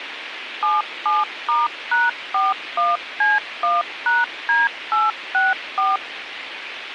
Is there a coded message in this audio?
Yes: DTMF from 0.6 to 6.0 s, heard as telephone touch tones, dialled by machine, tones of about 180 ms, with radio hiss. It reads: 77*#41C1#D864